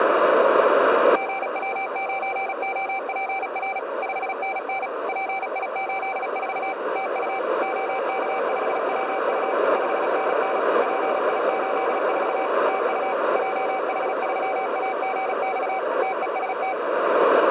Morse code, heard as a keyed tone, machine-sent, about 36 wpm, 770 Hz, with radio static and a narrow filter. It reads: GW9OPR 5NN PI84 TU OK5WU 5NN PI84 TU JH3AGX TEST